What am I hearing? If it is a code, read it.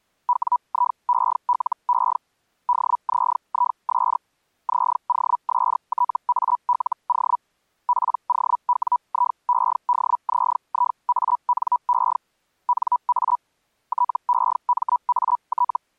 Hellschreiber (Feld-Hell, 122.5 baud), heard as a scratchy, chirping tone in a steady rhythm, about 980 Hz. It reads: WIELE DZIS ZOSTALO POWIEDZIANE NA TEMAT